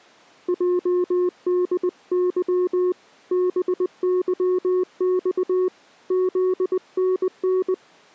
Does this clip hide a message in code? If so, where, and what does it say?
Yes: Morse code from 0.4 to 7.8 s, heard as a keyed tone, hand-sent with a paddle, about 20 wpm, 360 Hz. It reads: JDY BYX ZNN